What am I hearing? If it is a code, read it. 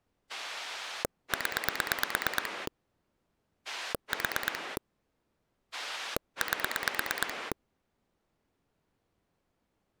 Pulse dialling, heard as a rotary dial, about 9 pulses a second. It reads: 0 4 8